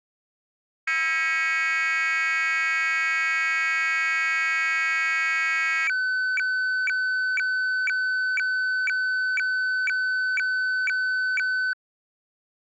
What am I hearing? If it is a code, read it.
Weather fax (radiofax), 120 lines a minute, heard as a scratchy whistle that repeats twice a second.